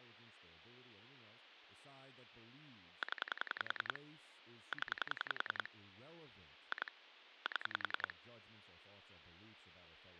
Pulse dialling, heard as clicks on a phone line, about 10 pulses a second, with speech in English. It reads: 0 0 2 7